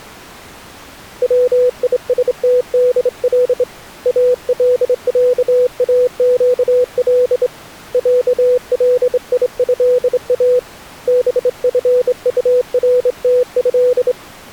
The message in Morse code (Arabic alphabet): ويستدل العاقل عليها بفطرته

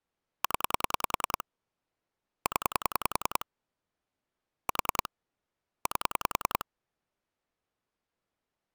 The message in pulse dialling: 0 0 4 8

